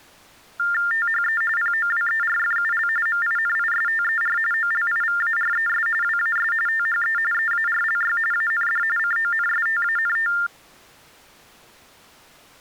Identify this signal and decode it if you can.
TTY/TDD text telephone tones (45.45 baud Baudot), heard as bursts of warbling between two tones, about 400 Hz shift, 1600 Hz centre. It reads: THE POWERFUL MINISTER OLIVARES WAS THE EARLY AND CONSTANT